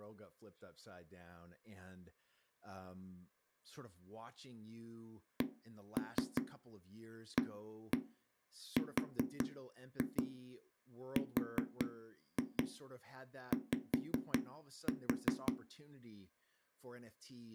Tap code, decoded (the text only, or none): CARRY